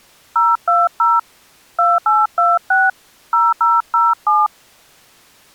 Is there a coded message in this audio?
Yes: DTMF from 0.4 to 4.5 s, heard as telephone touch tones, dialled by hand, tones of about 200 ms. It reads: 020 2826 0007